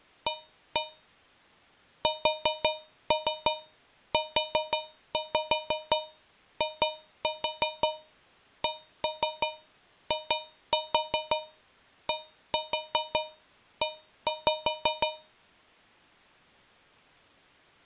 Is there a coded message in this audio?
Yes: tap code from 0.3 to 15.4 s, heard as taps on a metal pipe, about 5 knocks a second. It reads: A SUICIDE